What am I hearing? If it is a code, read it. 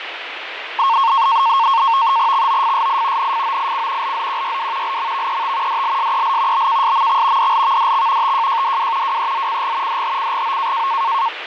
NAVTEX (SITOR-B), 100 baud, 170 Hz shift, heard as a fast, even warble, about 1000 Hz centre, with radio static and fading. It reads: XOFSI NFOIC LZQYW LMVET DLSEL BKSMX DLVDX TJJDW WEZCG DHCGO